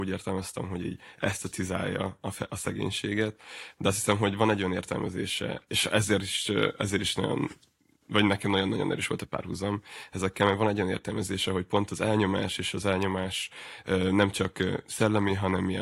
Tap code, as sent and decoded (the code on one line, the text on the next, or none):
none